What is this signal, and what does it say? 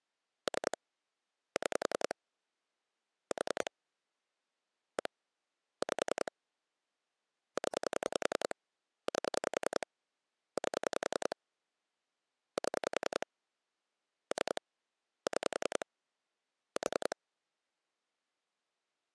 Pulse dialling, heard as clicks on a phone line, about 10 pulses a second. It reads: 3 6 4 1 5 0 8 8 7 3 6 4